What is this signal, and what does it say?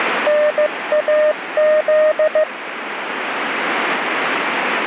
Morse code, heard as a keyed tone, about 15 wpm, 610 Hz, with radio static. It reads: NAZ